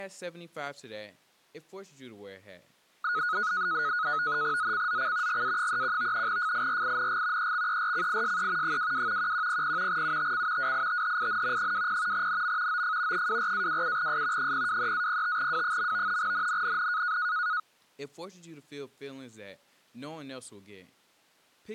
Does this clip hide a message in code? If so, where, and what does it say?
Yes: NAVTEX (SITOR-B), 100 baud, 170 Hz shift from 3.0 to 17.6 s, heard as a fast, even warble, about 1360 Hz centre, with speech in English. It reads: ZCZC GA31 FIRING EXERCISE 22 1100 UTC WITHIN 20 NM OF 24-27S 023-05W. NNNN